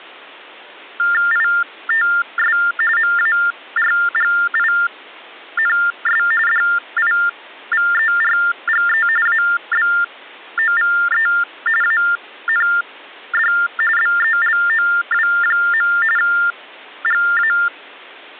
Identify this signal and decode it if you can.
TTY/TDD text telephone tones (45.45 baud Baudot), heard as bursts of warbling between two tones, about 400 Hz shift, 1600 Hz centre. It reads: ITS MARGINS DIVERGE ABOVE AND BELOW. GA